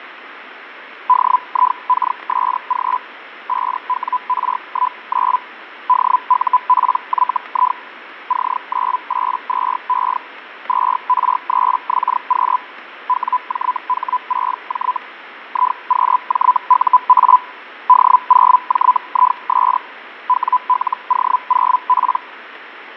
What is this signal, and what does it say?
Hellschreiber (Feld-Hell, 122.5 baud), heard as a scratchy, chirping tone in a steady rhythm, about 1000 Hz, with radio static and fading. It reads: DIKSG 5WR19 DUPYI C982E 2R3XQ WJH6J IQJUA D0JIS WLO0P